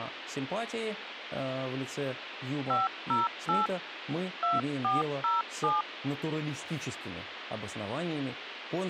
DTMF, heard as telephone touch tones, dialled by hand, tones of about 170 ms, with phone line noise. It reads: 508 2407